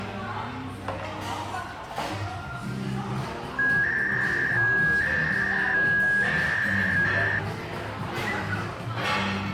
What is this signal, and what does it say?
300-baud modem data (V.21 tones), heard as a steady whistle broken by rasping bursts, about 300 baud, 200 Hz shift, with the noise of a restaurant.